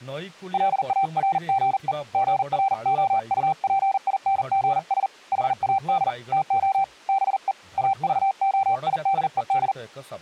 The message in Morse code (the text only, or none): LARGE GROUPINGS HAD TO BE AVOIDED